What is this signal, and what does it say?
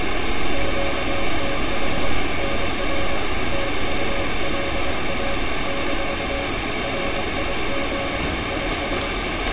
Morse code, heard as a keyed tone, hand-sent with a paddle, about 23 wpm, 550 Hz, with heavy radio static and street noise. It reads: QTH NR TULA - RIG IS